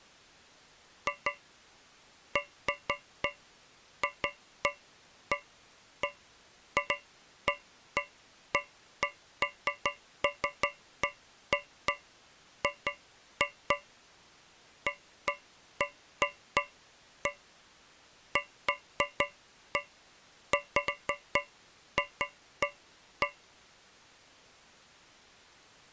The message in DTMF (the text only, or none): none